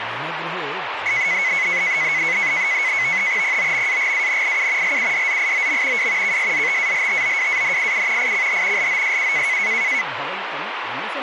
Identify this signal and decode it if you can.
NAVTEX (SITOR-B), 100 baud, 170 Hz shift, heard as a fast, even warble, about 2100 Hz centre, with radio static and speech in Sanskrit. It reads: POMAGANIU LUDZIOM W KSZTALTOWANIU ICH LOSU